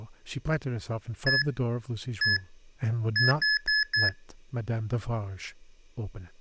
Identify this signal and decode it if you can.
Beep code, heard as beeps from a small speaker, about 1700 Hz, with speech in English. 1-1-4. In Phoenix BIOS tables: BIOS ROM checksum failure.